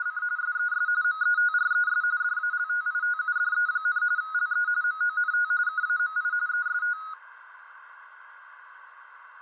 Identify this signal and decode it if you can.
RTTY (45.45 baud, 170 Hz shift), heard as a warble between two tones, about 1360 Hz centre, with radio static, fading and a narrow filter. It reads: … SES METRES DALTITUDE, LE MONT KAMI EST